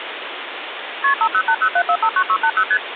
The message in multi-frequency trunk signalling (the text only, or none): KP 50807459680 ST